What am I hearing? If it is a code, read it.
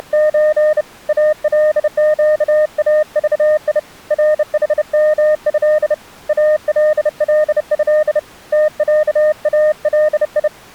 Morse code (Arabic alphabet), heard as a keyed tone, hand-sent with a bug key, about 30 wpm, 610 Hz. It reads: … القاضي رحمه الله تعالي